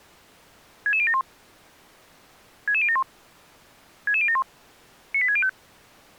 Five-tone selective call (ZVEI), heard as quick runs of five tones, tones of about 70 ms. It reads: 66071 66071 66071 98605